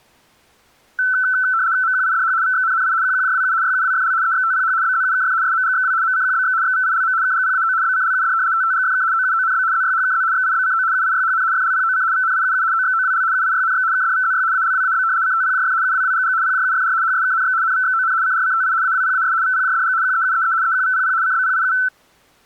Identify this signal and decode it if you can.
RTTY (75 baud, 170 Hz shift), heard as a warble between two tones, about 1420 Hz centre. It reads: MQIDH VXNNI QQJWU YUWFL EXTPH BZUKF SMGXW MCQBX XVILM KGPAO BCLUD TTGFK OUONB ZYHKZ XIBCO UIYHN FLPOC VNIUU OXOWL UIYNX KDVZY ALWAB CTPJF UWWGG PJUFR HSKNX NVXON CRCTI AWPAS VPJDG QEUEE EQVPP CBPIU